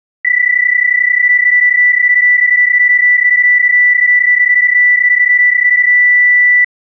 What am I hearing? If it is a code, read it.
PSK31 (31.25 baud), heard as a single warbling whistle, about 1950 Hz.